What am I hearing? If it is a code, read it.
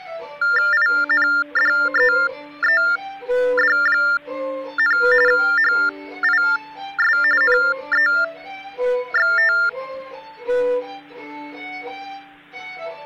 TTY/TDD text telephone tones (45.45 baud Baudot), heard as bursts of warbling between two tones, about 400 Hz shift, 1600 Hz centre. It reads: INDEED, HIS NEXT